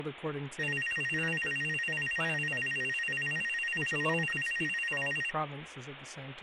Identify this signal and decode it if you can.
A tone that alternates evenly between two pitches, with phone line noise and speech in English. There is no code.